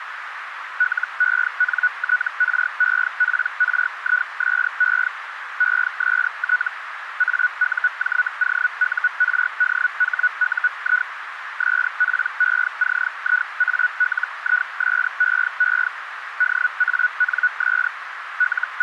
Hellschreiber (Feld-Hell, 122.5 baud), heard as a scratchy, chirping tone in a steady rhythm, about 1470 Hz, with radio static and a narrow filter. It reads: LENTREPRISE EST AUJOURDHUI SPECIALISEE DANS …